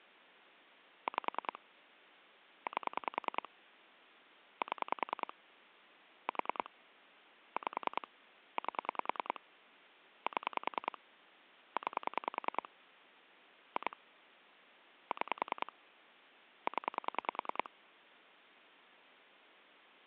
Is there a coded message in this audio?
Yes: pulse dialling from 1.1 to 17.7 s, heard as clicks on a phone line, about 10 pulses a second. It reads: 5 8 7 4 5 8 7 9 2 6 0